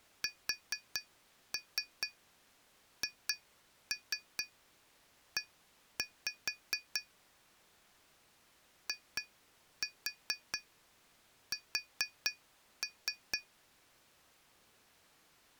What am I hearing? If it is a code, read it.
Tap code, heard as taps on glass, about 4 knocks a second. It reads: SHE IS